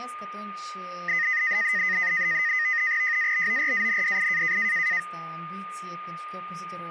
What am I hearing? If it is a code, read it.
NAVTEX (SITOR-B), 100 baud, 170 Hz shift, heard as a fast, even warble, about 1950 Hz centre, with a steady whistle near 1220 Hz and speech in Romanian. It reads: JABORANDI